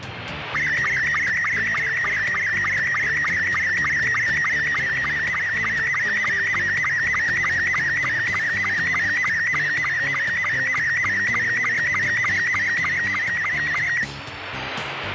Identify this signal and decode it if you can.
SSTV (slow-scan television), Robot 72, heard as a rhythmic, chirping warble, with radio static.